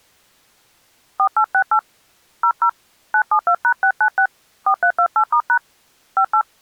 DTMF, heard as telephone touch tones, dialled by hand, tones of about 80 ms. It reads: 4868 00 972#696 4328*# 58